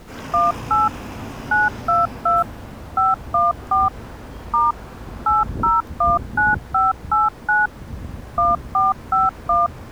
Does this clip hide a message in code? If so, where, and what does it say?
Yes: DTMF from 0.3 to 9.7 s, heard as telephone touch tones, dialled by machine, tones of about 170 ms, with street noise. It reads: 18 922 514 * 8019589 1451